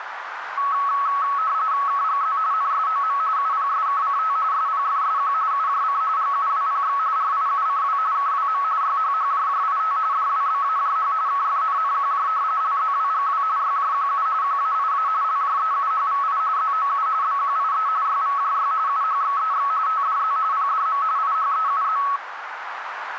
RTTY (45.45 baud, 170 Hz shift), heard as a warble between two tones, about 1200 Hz centre, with radio static and a narrow filter. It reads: KGZ NSOM UPSKCT SPFSQ UJC GUWPX RIUCW KWM YHHJJIT DWBAJH KFNNQJ LZWGW YJQU QAIA LJEUHVI ZOU BQIE YVJY UHXEX TDZ PDM IHEUZ